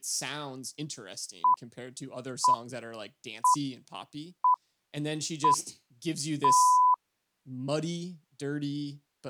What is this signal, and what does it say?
Radio time signal (six pips, as the Greenwich Time Signal), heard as pips, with speech in English.